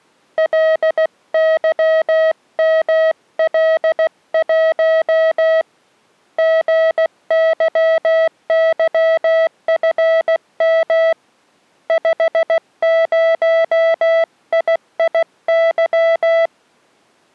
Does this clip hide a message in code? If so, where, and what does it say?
Yes: Morse code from 0.3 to 16.5 s, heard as a keyed tone, hand-sent with a paddle, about 16 wpm, 650 Hz. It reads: LYML1 GYYFM 50IIY